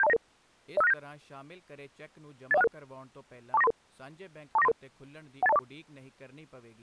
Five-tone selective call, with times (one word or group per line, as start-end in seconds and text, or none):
0.0-0.2 72099
0.8-0.9 05697
2.5-2.7 80166
3.5-3.7 24933
4.6-4.7 24933
5.4-5.6 18204